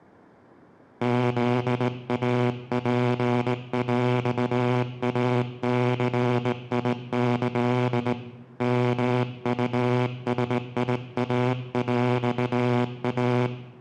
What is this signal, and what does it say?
Morse code (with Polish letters), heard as a buzzer, hand-sent with a straight key, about 18 wpm, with room echo. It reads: ZAPŁACIĆ MUSIAŁA